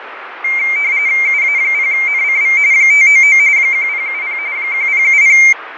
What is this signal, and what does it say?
RTTY (45.45 baud, 170 Hz shift), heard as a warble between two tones, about 2200 Hz centre, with radio static and fading. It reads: UA0NCV 599 1070 1070